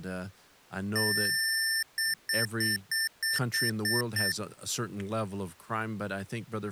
Beep code, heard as beeps from a small speaker, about 1800 Hz, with speech in English. 1 long, 8 short. In AMI BIOS tables: display or retrace test failure.